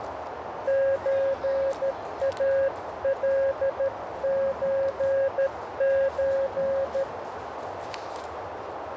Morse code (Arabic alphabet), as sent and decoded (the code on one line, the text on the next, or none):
---. .- .-.. ---. ---.
زالزز